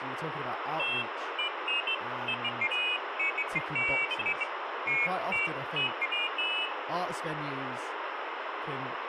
Pairs of high tones at irregular times, with phone line noise and speech in English. There is no code.